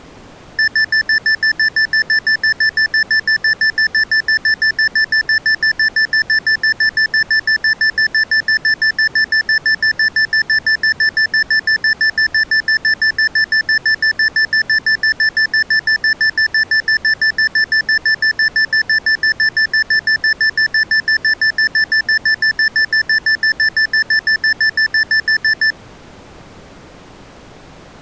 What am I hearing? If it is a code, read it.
Evenly repeated beeps. There is no code.